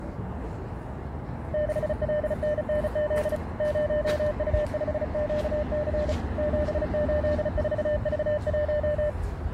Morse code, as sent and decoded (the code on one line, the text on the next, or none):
-.... .-.. -. -. --.. / ----- ..- ..... --.- -.-. / --... ---.. ....- ...- .----
6LNNZ 0U5QC 784V1